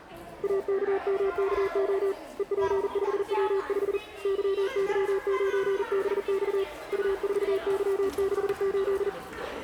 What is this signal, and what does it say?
Morse code, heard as a keyed tone, hand-sent with a paddle, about 40 wpm, 380 Hz, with the noise of a crowd indoors. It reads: AKMKO EP5W5 YY9BX U4Y68